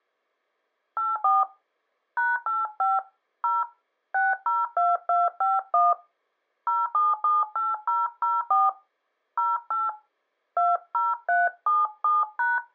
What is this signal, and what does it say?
DTMF, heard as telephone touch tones, dialled by hand, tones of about 190 ms. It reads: 84 #85 0 602251 0778004 08 20377#